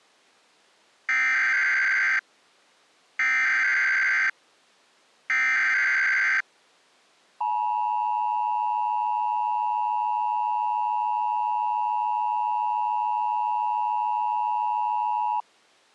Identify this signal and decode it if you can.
Emergency Alert System (SAME) tones (header bursts, then the 853 and 960 Hz attention tone), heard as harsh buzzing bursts, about 520.83 baud.